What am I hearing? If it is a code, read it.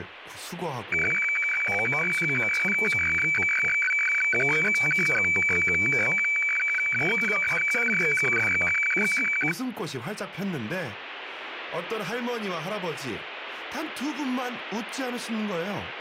Weather fax (radiofax), 120 lines a minute, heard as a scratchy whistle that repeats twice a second, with radio static and speech in Korean.